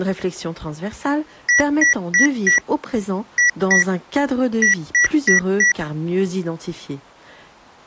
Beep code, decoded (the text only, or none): 4-2-4